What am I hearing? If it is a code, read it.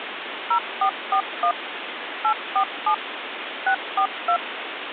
DTMF, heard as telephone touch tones, dialled by machine, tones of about 80 ms, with phone line noise. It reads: 0441 847 642